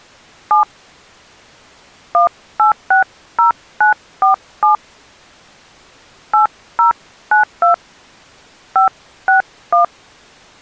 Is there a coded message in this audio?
Yes: DTMF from 0.5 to 9.8 s, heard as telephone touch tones, dialled by hand, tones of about 120 ms. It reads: 7 1860947 8092 561